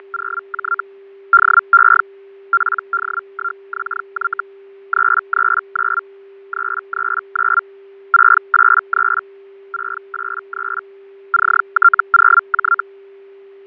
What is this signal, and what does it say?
Hellschreiber (Feld-Hell, 122.5 baud), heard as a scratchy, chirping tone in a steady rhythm, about 1380 Hz, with fading and a steady whistle near 390 Hz. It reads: … DE PD1XY 339 339 683 683 CT0J